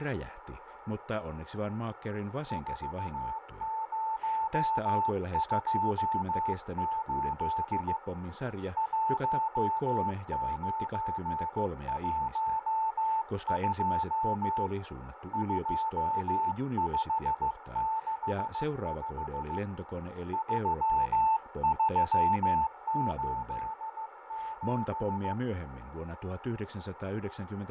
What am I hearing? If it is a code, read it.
Morse code, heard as a keyed tone, hand-sent with a paddle, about 15 wpm, 880 Hz, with radio static, fading, a narrow filter and speech in Finnish. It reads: 4028 1912 2565 3387